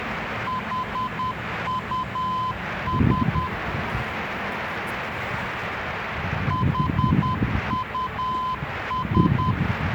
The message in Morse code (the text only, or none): HUS HUS